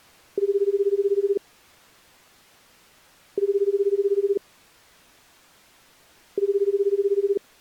Telephone call progress tone (Japanese plan), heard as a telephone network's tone, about 380, 400, 420 Hz, 1 s on and 2 s off. Ringback tone.